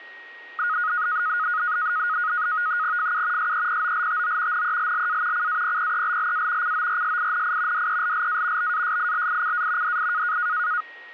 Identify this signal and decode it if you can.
NAVTEX (SITOR-B), 100 baud, 170 Hz shift, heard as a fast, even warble, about 1350 Hz centre, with a steady whistle near 1880 Hz. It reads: FU SEPOLTO NELLA CAPPELLA CORSINI DELLA BASILICA DI